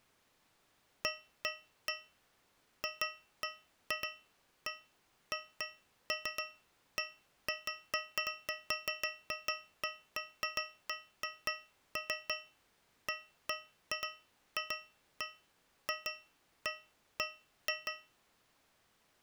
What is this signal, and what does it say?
Irregular taps on a metal pipe. There is no code.